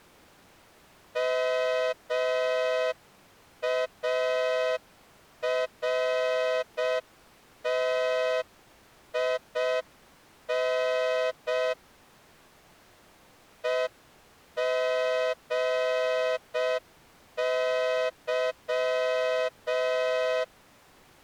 Morse code, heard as a horn, hand-sent with a straight key, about 6 wpm. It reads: MARTIN EGY